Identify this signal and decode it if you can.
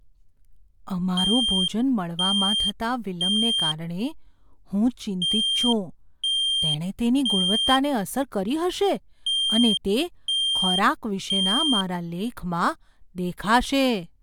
Alarm pattern, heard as an alarm's beeps, played three times, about 3200 Hz, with speech in Gujarati. Temporal three. Smoke or fire, evacuate.